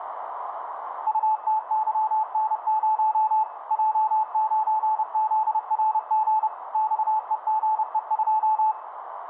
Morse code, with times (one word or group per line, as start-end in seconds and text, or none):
1.1-3.4 UTYN0
3.7-6.5 J9ZRG
6.7-8.7 XEGE2